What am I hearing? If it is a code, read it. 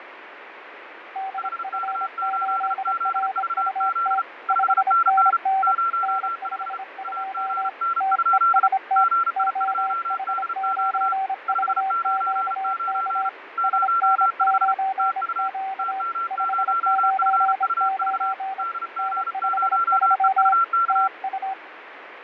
Morse code, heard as two keyed tones, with radio static and fading. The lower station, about 26 wpm, 770 Hz: DF8RUT 5NN N52 TEST OH9VQK SN9Q 599 N53 TU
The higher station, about 34 wpm, 1360 Hz: HK8ZVZ 5NN 05 AGN? GI2DQ 599 05 TU TM0FUV DG0EUK